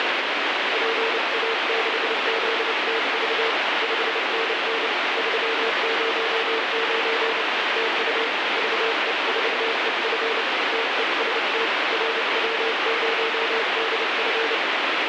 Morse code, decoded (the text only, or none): PA6ZTV 5NN 309 TU VE4EF TEST RW0DF